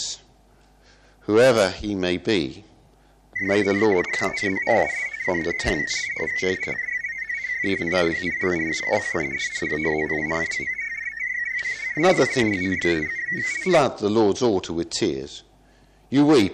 Multi-tone FSK (Olivia or MFSK type), about 500 Hz wide, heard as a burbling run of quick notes, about 62.5 baud.